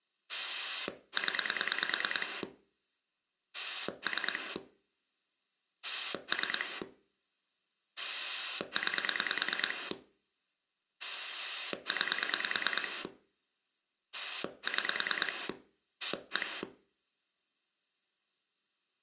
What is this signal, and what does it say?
Pulse dialling, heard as a rotary dial, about 9 pulses a second. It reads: 0 3 3 9 9 6 1